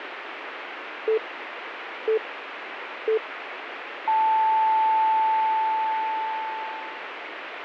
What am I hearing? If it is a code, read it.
Radio time signal (three low pips and a long one an octave up, as on NHK), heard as pips, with radio static.